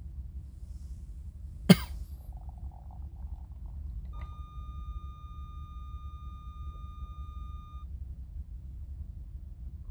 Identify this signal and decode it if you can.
A steady tone, with the noise inside a car. There is no code.